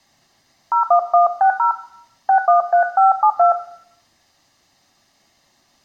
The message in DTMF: 01160 613572

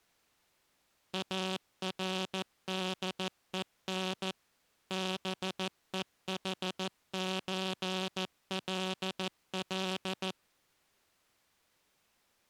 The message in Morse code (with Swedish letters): ARDEN BEHÖLL

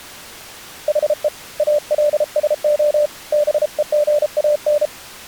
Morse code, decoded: HE ALSO BEGAN

